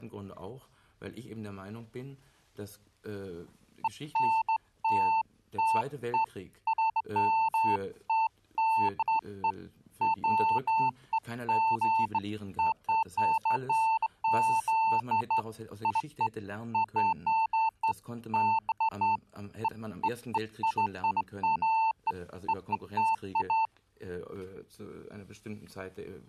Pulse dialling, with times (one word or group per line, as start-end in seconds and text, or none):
none